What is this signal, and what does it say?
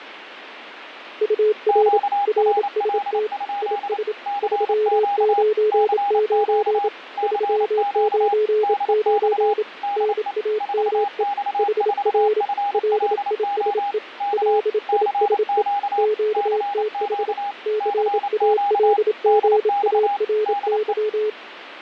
Morse code, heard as two keyed tones, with radio static. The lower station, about 27 wpm, 430 Hz: UR RST IS 399 399 NAME HR LISE LISE QTH CALGARY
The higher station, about 28 wpm, 810 Hz: QRL? CQ CQ CQ DX DE 4X4FLO K CQ CQ CQ DX DE